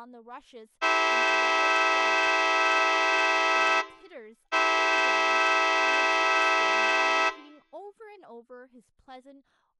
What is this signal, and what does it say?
Train horn signal, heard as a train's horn, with room echo and speech in English. 2 long. On North American railways: brakes released, proceed.